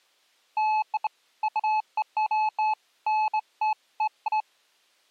Beeps of irregular length. There is no code.